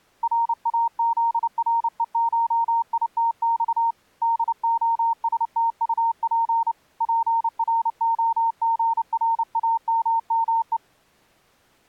Morse code (Russian alphabet), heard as a keyed tone, hand-sent with a paddle, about 29 wpm, 920 Hz. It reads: РАЗРЕШИТЬ ДОСТУП ПРОГРАММЕ